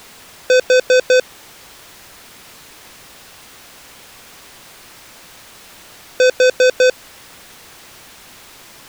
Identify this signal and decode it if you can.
Alarm pattern, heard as an alarm's beeps, played twice, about 510 Hz. Temporal four. Carbon monoxide.